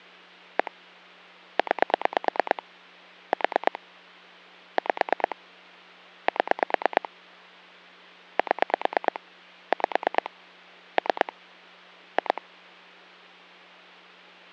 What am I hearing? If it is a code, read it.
Pulse dialling, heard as clicks on a phone line, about 9 pulses a second, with hum. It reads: 1 9 4 5 7 7 5 3 2